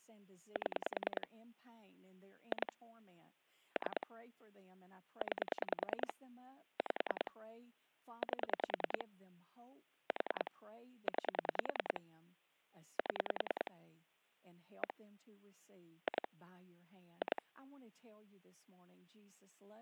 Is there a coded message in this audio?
Yes: pulse dialling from 0.6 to 17.4 s, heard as clicks on a phone line, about 10 pulses a second, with speech in English. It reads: 7 2 3 9 5 8 4 9 7 1 2 2